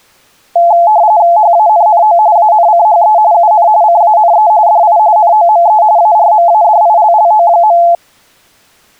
RTTY (45.45 baud, 170 Hz shift), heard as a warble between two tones, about 770 Hz centre. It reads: HANNO ANCHE UN CANE DI NOME ARMADILLO.